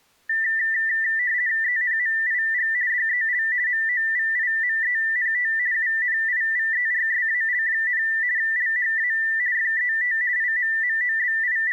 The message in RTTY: ENMIG DEL MOVIMENT UNIVERSAL, LHA FET …

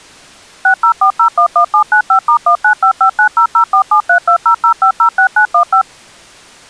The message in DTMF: 604011795*1955900473200506915

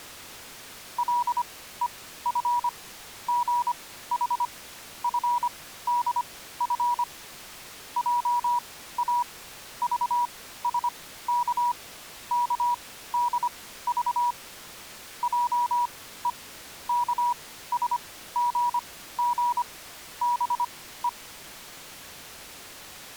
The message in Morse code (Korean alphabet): 간수는 호령을 하였다

